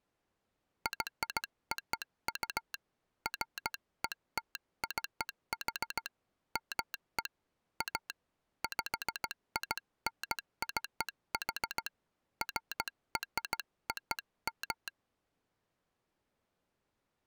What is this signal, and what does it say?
Morse code (American railroad code), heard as a telegraph sounder, hand-sent with a straight key. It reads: YOU FETCH ME A PINCH FROM